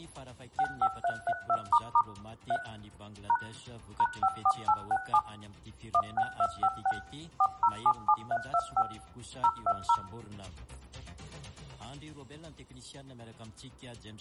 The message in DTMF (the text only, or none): 65332** 3 # #54867 16256 4077325 020